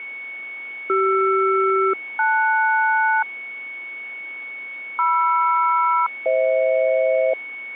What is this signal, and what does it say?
Aircraft SELCAL, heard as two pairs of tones, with a steady whistle near 2220 Hz. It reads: CR-LS MR-FH